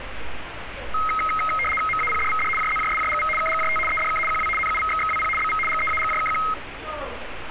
RTTY (75 baud, 850 Hz shift), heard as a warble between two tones, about 1700 Hz centre, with radio static and street noise. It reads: MAPDVD JZJSJGV KGJT EDK QW NUVXXWP BV GEAGJKQ